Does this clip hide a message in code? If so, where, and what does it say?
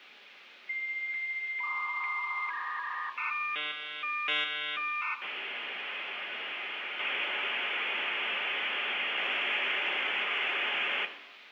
Yes: dial-up modem handshake (V.34 or later) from 0.7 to 11.1 s, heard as a whistle, warbles, then hiss, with phone line noise and room echo.